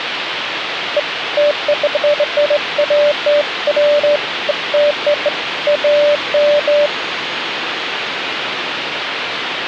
Beeps of irregular length, with phone line noise and the noise inside a subway train. There is no code.